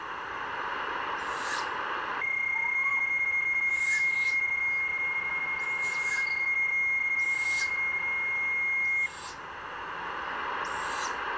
PSK31 (31.25 baud), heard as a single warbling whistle, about 2150 Hz, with radio static.